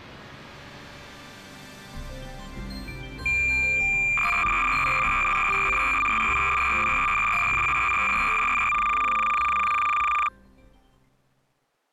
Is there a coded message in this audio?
Yes: cassette data (Kansas City type), 300 baud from 3.3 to 10.3 s, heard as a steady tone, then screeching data.